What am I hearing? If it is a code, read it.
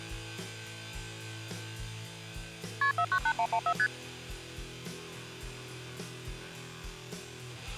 Multi-frequency trunk signalling (R1, as on North American trunks), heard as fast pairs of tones, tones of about 70 ms. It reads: KP 498114 ST